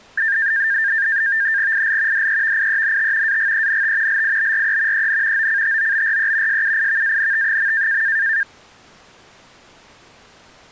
NAVTEX (SITOR-B), 100 baud, 170 Hz shift, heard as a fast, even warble, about 1700 Hz centre. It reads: IL DEVIENT AGENT LIBRE EN OCTOBRE SUIVANT.